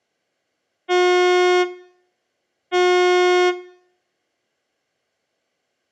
Ship horn signal, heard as a ship's horn, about 360 Hz. 2 short. At sea: I am altering course to port.